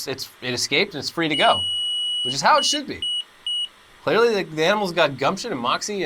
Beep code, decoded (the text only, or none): 1 long, 3 short